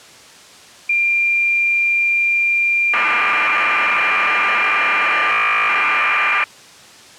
Cassette data (Kansas City type), 1200 baud, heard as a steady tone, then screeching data.